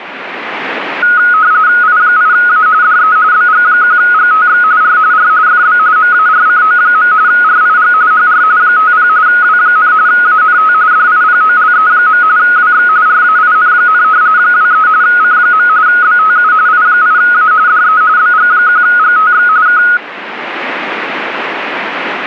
RTTY (45.45 baud, 170 Hz shift), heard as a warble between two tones, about 1360 Hz centre. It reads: I8A DE BG1GTX R R FB MARCO. RIG HR 50 W, ANT DIPOLE. WX RAIN, 23 C. BTU I8A DE BG1GTX K